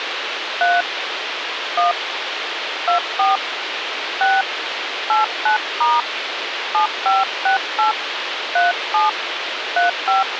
DTMF, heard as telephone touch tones, dialled by hand, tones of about 160 ms, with radio hiss. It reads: 3 1 24 6 89* 7568 37 35